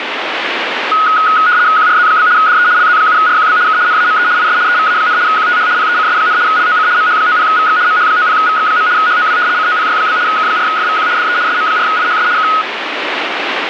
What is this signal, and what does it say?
RTTY (75 baud, 170 Hz shift), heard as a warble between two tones, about 1360 Hz centre, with radio static. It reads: QRZ? DE LZ7RQB K NAME IS EVA, QTH PECS, LOC MH90VX MH90VX. HOW COPY? K4FVQ DE SM4IHS K